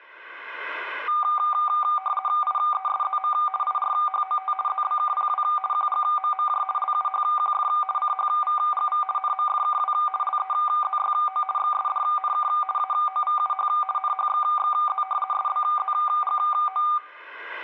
RTTY (50 baud, 450 Hz shift), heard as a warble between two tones, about 980 Hz centre, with room echo. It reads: IESZM IRHOT ZBKPW QGMMJ LUHQF CHVGV NMFKW LEZYO XSDNK AOVUH NHXXZ SBZGO